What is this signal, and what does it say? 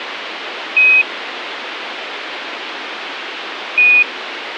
Quindar tones, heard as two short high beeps, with radio hiss.